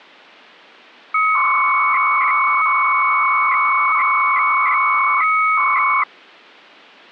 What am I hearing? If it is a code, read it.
300-baud modem data (Bell 103 tones), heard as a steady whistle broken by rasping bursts, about 300 baud, 200 Hz shift.